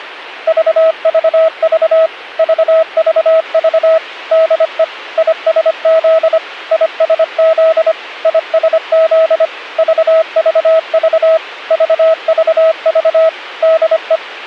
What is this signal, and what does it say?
Morse code, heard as a keyed tone, machine-sent, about 25 wpm, 650 Hz. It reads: VVV VVV DE ISZ ISZ ISZ VVV VVV DE